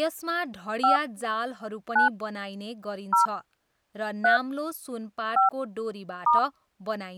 DTMF, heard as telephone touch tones, dialled by hand, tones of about 130 ms, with speech in Nepali. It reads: 5 9 0 3 5 *